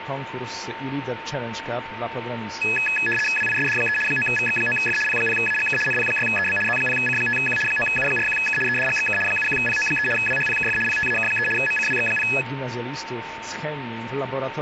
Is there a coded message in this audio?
Yes: RTTY (75 baud, 850 Hz shift) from 2.6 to 12.4 s, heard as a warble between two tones, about 2100 Hz centre, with radio static and a steady whistle near 900 Hz. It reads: WISD3 9VX9F P0AGK NP6EB Z0C5Q 9U41K EDGXK 71PO3 WHPKF PTAK3 MCWX0